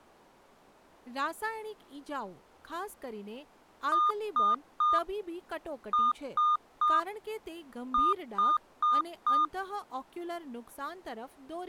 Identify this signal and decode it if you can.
Beep code, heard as beeps, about 1220 Hz, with speech in Gujarati. 3-3-4. In Phoenix BIOS tables: video failure.